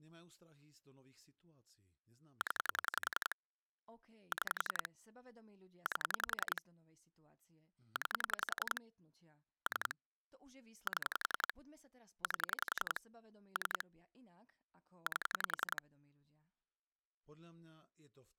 Pulse dialling, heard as clicks on a phone line, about 11 pulses a second, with speech in Slovak. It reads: 0 6 8 9 3 7 8 3 8